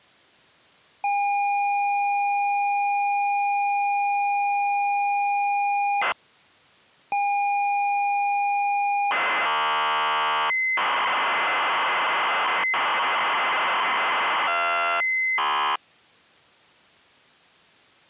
ZX Spectrum tape loading, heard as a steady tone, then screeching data.